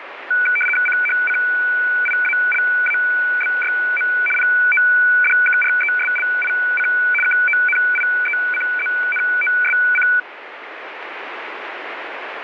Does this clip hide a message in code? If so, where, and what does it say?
Yes: RTTY (75 baud, 850 Hz shift) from 0.3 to 10.2 s, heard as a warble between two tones, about 1900 Hz centre, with radio static. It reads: CHCIALABYM PODKRESLIC KONIECZNOSC